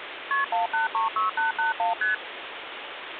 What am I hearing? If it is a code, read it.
Multi-frequency trunk signalling (R1, as on North American trunks), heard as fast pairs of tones, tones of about 140 ms, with phone line noise. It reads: KP 1836881 ST